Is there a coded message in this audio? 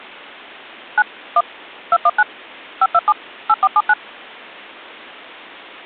Yes: DTMF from 1.0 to 3.9 s, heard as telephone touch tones, dialled by machine, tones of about 50 ms. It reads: 9 1 219 527 8479